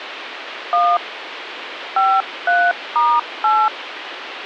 DTMF, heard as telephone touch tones, dialled by hand, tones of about 240 ms, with phone line noise. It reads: 1 53*8